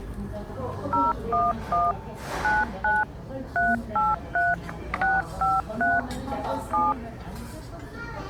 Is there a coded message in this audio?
Yes: DTMF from 0.9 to 6.9 s, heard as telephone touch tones, dialled by machine, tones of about 190 ms, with the noise of a restaurant. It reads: 011 99 383 653 7